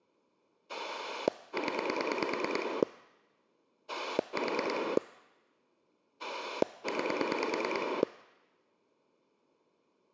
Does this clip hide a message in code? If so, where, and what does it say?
Yes: pulse dialling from 0.7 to 8.0 s, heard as a rotary dial, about 9 pulses a second. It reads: 0 4 9